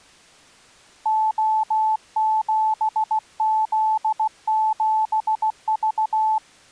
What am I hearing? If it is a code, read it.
Morse code, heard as a keyed tone, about 16 wpm, 870 Hz. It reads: O7Z7V